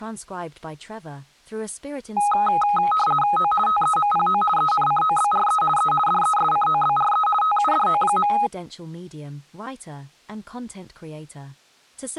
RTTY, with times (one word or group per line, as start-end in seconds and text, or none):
3.4-3.5 O
3.7-4.4 TEMPO
4.6-5.6 ENCOBRE
5.8-5.9 E
6.1-7.3 DESCOBRE
7.4-8.3 TUDO.